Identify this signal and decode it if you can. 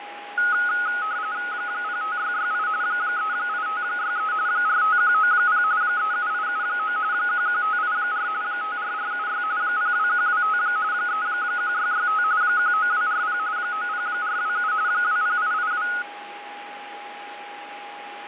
RTTY (45.45 baud, 170 Hz shift), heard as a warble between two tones, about 1360 Hz centre, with radio static, fading and a steady whistle near 820 Hz. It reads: 05668 38563 45190 37879 11584 54476 02125 31665 19240 90427 20882